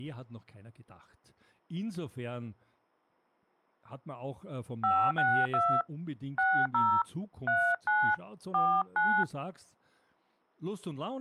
DTMF, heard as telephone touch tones, dialled by hand, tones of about 270 ms, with speech in German. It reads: 562 60 39 49